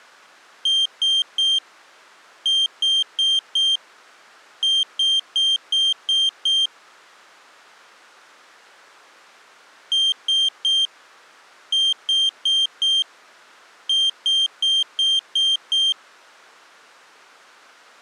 Beep code, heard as a piezo beeper, played twice, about 3150 Hz. 3-4-6.